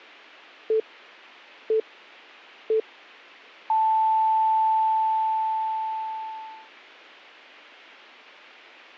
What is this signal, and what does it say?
Radio time signal (three low pips and a long one an octave up, as on NHK), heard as pips.